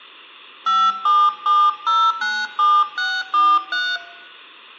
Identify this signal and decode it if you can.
DTMF, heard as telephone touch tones, dialled by hand, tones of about 240 ms, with room echo. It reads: 577097643